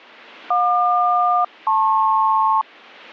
Aircraft SELCAL, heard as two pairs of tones, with radio static. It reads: JQ-LP